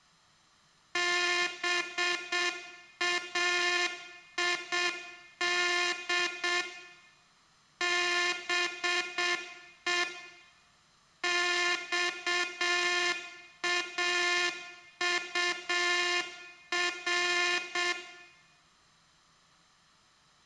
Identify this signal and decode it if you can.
Morse code (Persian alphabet), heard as a buzzer, machine-sent, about 7 wpm, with room echo. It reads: باید به خاطر